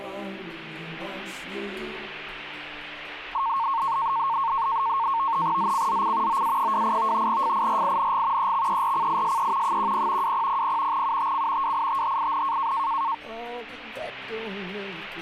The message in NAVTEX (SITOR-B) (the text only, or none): ZCZC OA28 FIRING EXERCISE 10 2000 UTC WITHIN